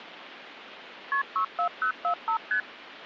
Multi-frequency trunk signalling (R1, as on North American trunks), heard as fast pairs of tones, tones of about 90 ms, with phone line noise. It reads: KP 64045 ST